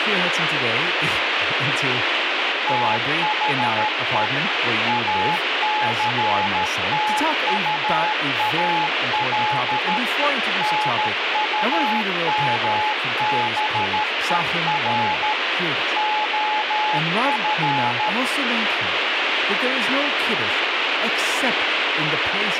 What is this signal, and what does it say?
Morse code, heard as a keyed tone, machine-sent, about 13 wpm, 850 Hz, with radio static and speech in English. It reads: THE ACTUAL NUMBER OF